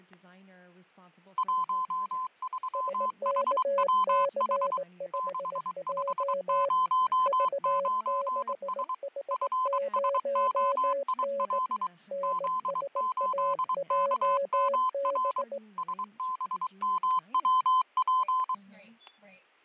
Morse code, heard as two keyed tones, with fading, static crashes and speech in English. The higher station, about 23 wpm, 1030 Hz: 13HWH 6509S FSOIL Z8KMR SBMWP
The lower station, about 18 wpm, 560 Hz: SKC5J V6H0N NSAJB